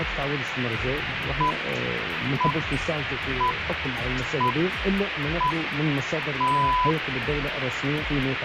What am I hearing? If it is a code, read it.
Radio time signal (six pips, as the Greenwich Time Signal), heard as pips, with radio hiss.